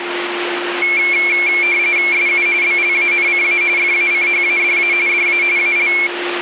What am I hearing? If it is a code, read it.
RTTY (45.45 baud, 170 Hz shift), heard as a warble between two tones, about 2250 Hz centre, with radio static and a steady whistle near 350 Hz. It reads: SU BLANCA FACHADA DA AL